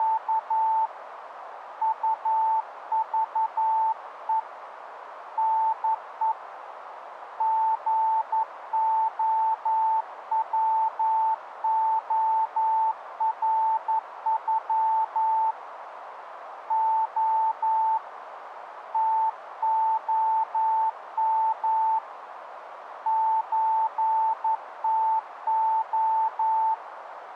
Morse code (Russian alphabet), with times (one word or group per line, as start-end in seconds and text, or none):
0.0-0.9 …
1.8-4.4 УЖЕ
5.4-6.3 НЕ
7.4-15.5 ГОВОРЮ
16.7-18.0 О
18.9-22.0 ТОМ
23.1-26.7 ЧТО